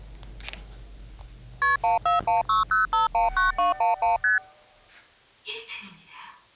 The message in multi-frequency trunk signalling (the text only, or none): KP 14160519211 ST